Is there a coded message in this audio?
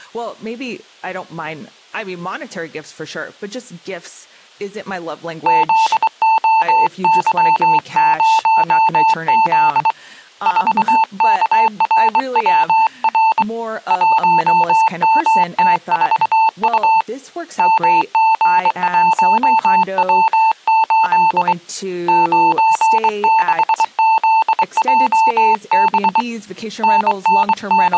Yes: Morse code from 5.4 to 28.0 s, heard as a keyed tone, hand-sent with a straight key, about 23 wpm, 890 Hz, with speech in English. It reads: ZOY0Z 4KRWR 1MT4U MG1W8 96ZJB …